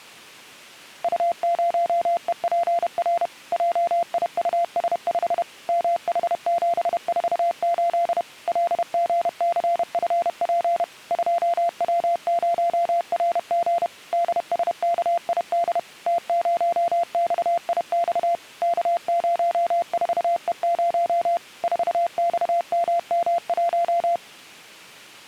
Morse code, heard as a keyed tone, machine-sent, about 31 wpm, 690 Hz. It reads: U0EPR JIUS5 MH748 LGCFP 2W0RG DSKID T0XIX K04E0 4XMM1